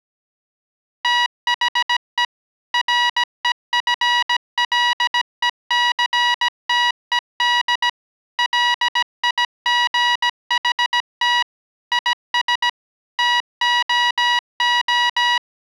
Morse code, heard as electronic beeps, machine-sent, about 17 wpm, 970 Hz. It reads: THE REFLECTED LIGHT IS TOO